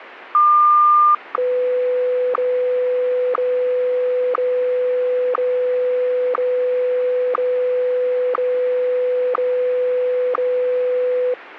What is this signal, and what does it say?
Radio time signal (WWVH, Hawaii), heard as ticks, one a second, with radio static.